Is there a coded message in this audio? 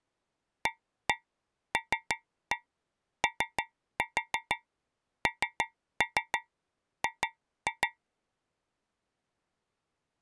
Yes: tap code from 0.7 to 8.0 s, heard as taps on a metal pipe, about 6 knocks a second. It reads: ALONG